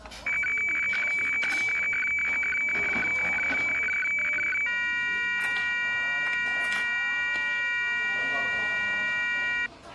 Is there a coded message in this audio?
Yes: weather fax (radiofax), 120 lines a minute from 0.3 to 9.7 s, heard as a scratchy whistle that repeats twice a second, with the noise of a crowd indoors.